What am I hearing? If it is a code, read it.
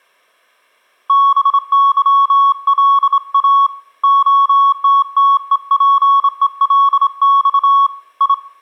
Morse code (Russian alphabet), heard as a keyed tone, hand-sent with a straight key, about 26 wpm, 1110 Hz, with room echo. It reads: БЫЛА ОТТЕПЕЛЬ И